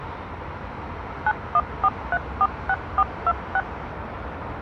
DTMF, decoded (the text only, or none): 914346426